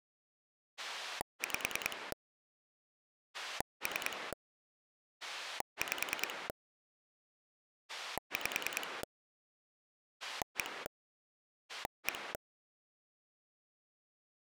Pulse dialling, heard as a rotary dial, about 10 pulses a second. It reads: 5 3 5 5 1 1